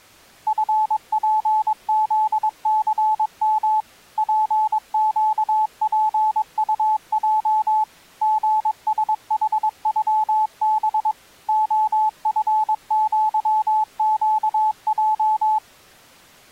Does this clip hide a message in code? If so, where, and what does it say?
Yes: Morse code (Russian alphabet) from 0.4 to 15.6 s, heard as a keyed tone, machine-sent, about 22 wpm, 860 Hz. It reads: ФПЗЦМ ПЩПУЙ ГСХЮБ ОФЪЩЙ